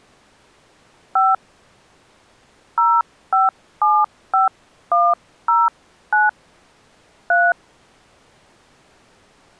DTMF, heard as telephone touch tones, dialled by hand, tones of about 230 ms. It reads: 5 0575109 3